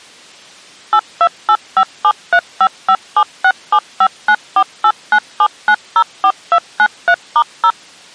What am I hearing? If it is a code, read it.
DTMF, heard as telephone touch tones, dialled by machine, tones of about 60 ms. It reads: 82857355767594897904293*0